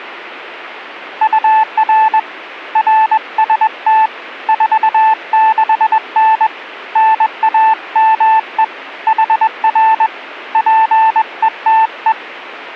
Morse code, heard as a keyed tone, hand-sent with a paddle, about 21 wpm, 880 Hz. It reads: UR RST 46N NAME HR PETE